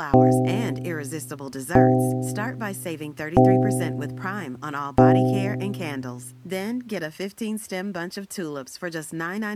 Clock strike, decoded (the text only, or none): 4